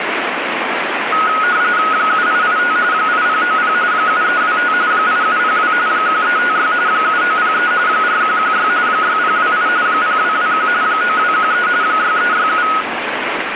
RTTY (45.45 baud, 170 Hz shift), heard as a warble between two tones, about 1360 Hz centre, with radio static. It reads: 7885 8090 7325 8702 1356 7903 4116 6028 0221 9213 6367